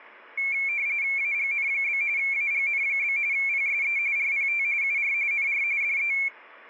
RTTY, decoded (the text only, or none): AGN? AGN? PSE RPT UR NR DE